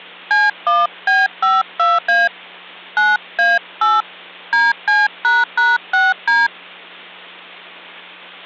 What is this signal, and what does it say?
DTMF, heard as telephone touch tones, dialled by hand, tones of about 190 ms, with hum. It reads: C1B52A 9A8 DC##6D